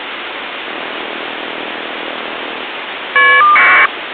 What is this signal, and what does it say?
Caller ID data burst, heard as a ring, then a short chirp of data, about 1200 baud, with phone line noise.